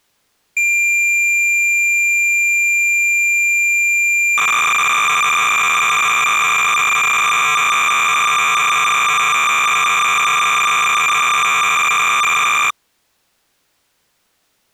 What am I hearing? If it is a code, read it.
Cassette data (Kansas City type), 300 baud, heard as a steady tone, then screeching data.